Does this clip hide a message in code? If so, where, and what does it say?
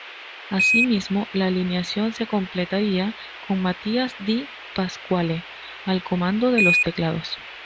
Yes: Quindar tones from 0.6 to 6.8 s, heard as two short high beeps.